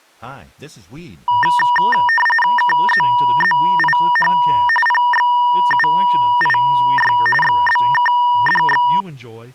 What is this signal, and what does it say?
RTTY (45.45 baud, 850 Hz shift), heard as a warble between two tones, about 1400 Hz centre, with speech in English. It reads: KZZIH PXUIY XBKDX